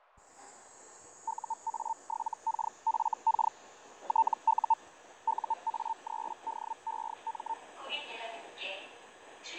Hellschreiber (Feld-Hell, 122.5 baud), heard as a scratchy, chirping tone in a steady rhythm, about 900 Hz, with fading and the noise inside a subway train. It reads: UA7KFK TU UA3DEM